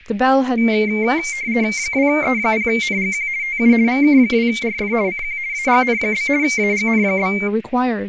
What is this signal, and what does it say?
RTTY (50 baud, 170 Hz shift), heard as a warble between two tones, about 2200 Hz centre, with radio static and speech in English. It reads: 2E0NGQ TU VK2RF CQ AGN? AGN?